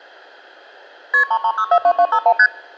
Multi-frequency trunk signalling (R1, as on North American trunks), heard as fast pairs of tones, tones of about 70 ms. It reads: KP 33642251 ST